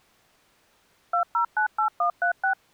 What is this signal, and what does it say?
DTMF, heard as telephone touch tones, dialled by machine, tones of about 100 ms. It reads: 2098136